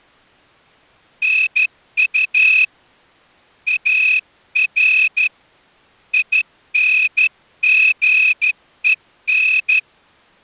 Morse code, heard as a whistle, hand-sent with a straight key, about 13 wpm. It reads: NU AR INGEN